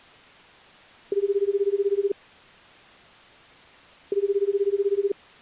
Telephone call progress tone (Japanese plan), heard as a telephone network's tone, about 380, 400, 420 Hz, 1 s on and 2 s off. Ringback tone.